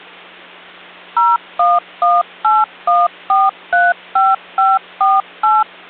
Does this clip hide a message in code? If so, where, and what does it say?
Yes: DTMF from 1.2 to 5.6 s, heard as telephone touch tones, dialled by machine, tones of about 200 ms, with hum. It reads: 01181435548